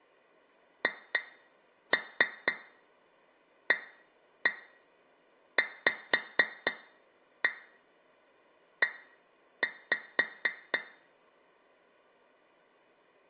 Tap code, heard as taps on glass, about 4 knocks a second, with room echo. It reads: HAVE